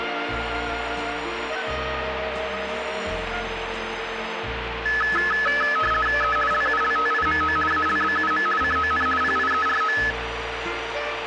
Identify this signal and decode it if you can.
RTTY (50 baud, 450 Hz shift), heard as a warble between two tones, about 1500 Hz centre, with radio static and a steady whistle near 450 Hz. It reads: E LULTIMO ALBUM CON PIERO